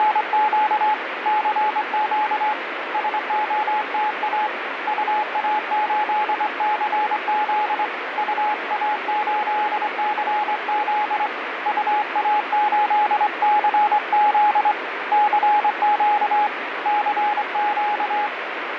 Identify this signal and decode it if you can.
Morse code, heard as a keyed tone, hand-sent with a straight key, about 24 wpm, 840 Hz, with radio static. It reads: … CQ SOTA UA8CZ UA8CZ UA8CZ CQ CQ